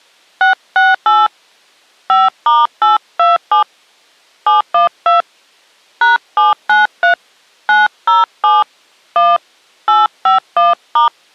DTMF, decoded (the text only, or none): 668 5*827 712 #793 907 1 851*